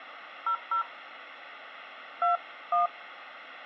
DTMF, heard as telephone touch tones, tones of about 100 ms, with phone line noise. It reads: 00 21